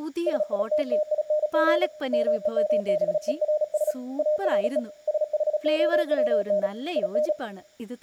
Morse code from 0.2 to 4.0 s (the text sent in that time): SITTING MEMBERS